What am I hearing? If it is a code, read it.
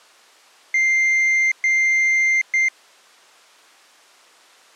Beep code, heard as a piezo beeper, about 2100 Hz. 2 long, 1 short.